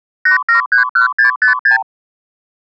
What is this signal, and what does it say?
Multi-frequency trunk signalling (R2, with the far end's replies), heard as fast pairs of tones, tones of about 120 ms. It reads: 8731656